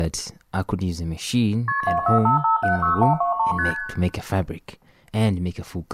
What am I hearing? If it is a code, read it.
Multi-frequency trunk signalling (R1, as on North American trunks), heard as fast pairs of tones, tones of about 120 ms, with room echo and speech in English. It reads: KP 245576123 ST